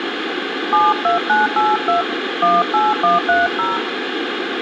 DTMF, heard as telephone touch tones, dialled by hand, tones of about 160 ms, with phone line noise. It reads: 72982 18130